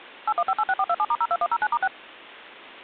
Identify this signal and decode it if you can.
DTMF, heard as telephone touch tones, dialled by machine, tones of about 50 ms. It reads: 81586427*02109*6